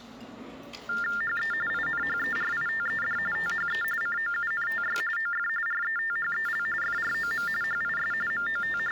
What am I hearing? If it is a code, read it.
TTY/TDD text telephone tones (45.45 baud Baudot), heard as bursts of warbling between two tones, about 400 Hz shift, 1600 Hz centre, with the noise of a restaurant. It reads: HE INHERITED THE COUNTY OF RETHEL FROM HIS …